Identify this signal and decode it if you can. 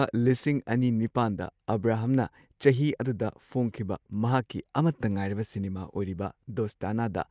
Speech in Manipuri. There is no code.